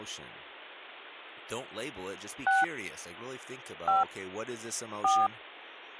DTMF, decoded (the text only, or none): 6 5 4